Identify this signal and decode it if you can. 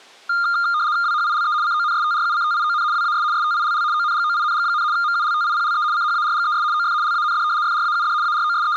RTTY (75 baud, 170 Hz shift), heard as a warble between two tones, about 1310 Hz centre. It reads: WHILE CONSTRUCTION WAS STILL ONGOING, MULTIPLE CHARGES OF LAND FRAUD …